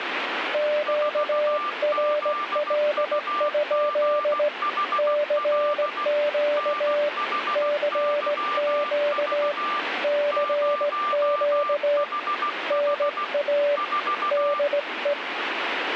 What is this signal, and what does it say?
Morse code, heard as two keyed tones, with radio static. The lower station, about 17 wpm, 590 Hz: QRL? CQ CQ CQ NA DE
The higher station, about 16 wpm, 1180 Hz: 4ZUGHL NHYV 0HH 4